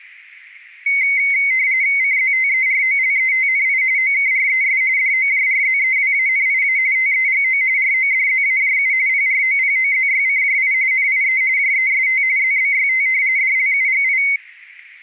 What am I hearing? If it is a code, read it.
RTTY (45.45 baud, 170 Hz shift), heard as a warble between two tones, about 2150 Hz centre, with static crashes. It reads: CZTEROLETNI OKRES DOJRZEWANIA TEGO RODZAJU PROPOZYCJI NIE JEST ZBYT DLUGI